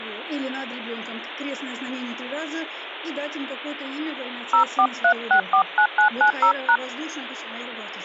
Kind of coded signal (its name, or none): DTMF